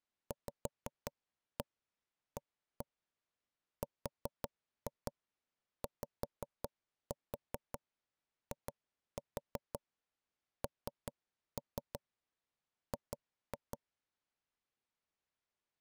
Tap code, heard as knocks on wood, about 5 knocks a second. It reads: VARYING